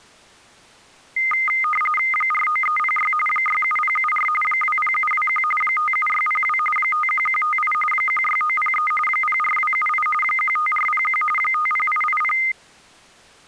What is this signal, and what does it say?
RTTY (45.45 baud, 850 Hz shift), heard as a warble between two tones, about 1650 Hz centre. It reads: 49306 67074 20721 57602 51158 16903 04278 15401 50880